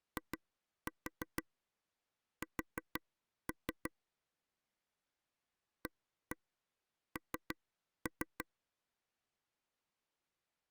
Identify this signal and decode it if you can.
Tap code, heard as taps on a table, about 6 knocks a second. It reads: IS AN